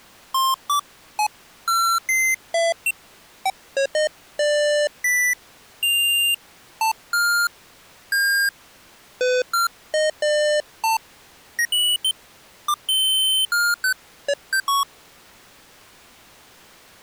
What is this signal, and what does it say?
Electronic bleeps of random pitch and length. There is no code.